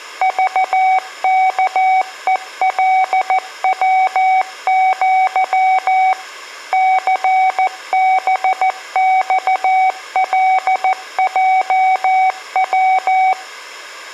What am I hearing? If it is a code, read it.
Morse code (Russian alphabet), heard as a keyed tone, machine-sent, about 14 wpm, 750 Hz. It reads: ЖКЕЛВЪ ЦБЬЛЙВ